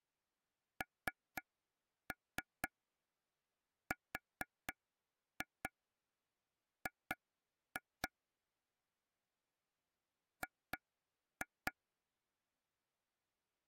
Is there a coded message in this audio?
Yes: tap code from 0.8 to 11.7 s, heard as taps on a table, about 4 knocks a second. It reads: NRG G